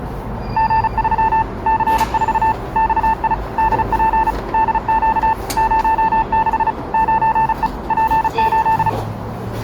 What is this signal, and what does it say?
Morse code, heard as a keyed tone, machine-sent, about 35 wpm, 890 Hz, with the noise inside a lift. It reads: G3 C4 XI DP DQ 06 9E P8